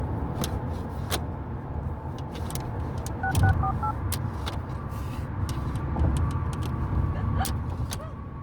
DTMF, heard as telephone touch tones, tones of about 80 ms, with the noise inside a car. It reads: 6648